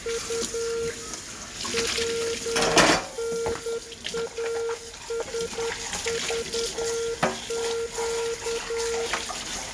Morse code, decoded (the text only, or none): U WNASVQ